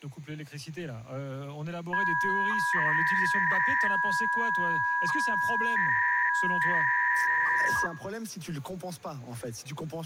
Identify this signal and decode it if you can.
300-baud modem data (V.21 tones), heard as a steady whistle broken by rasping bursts, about 300 baud, 200 Hz shift.